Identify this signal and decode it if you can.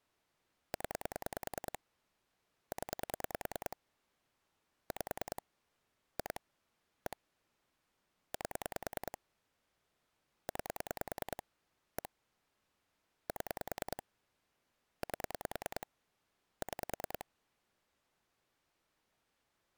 Pulse dialling, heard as clicks on a phone line, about 10 pulses a second. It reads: 0 0 5 2 1 8 9 1 7 8 6